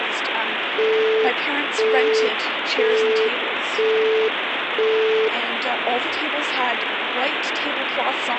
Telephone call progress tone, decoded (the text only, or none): busy tone